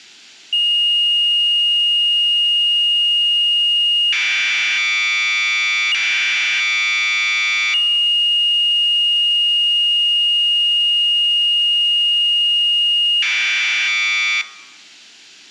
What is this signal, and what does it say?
Commodore tape loading (standard loader), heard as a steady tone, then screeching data.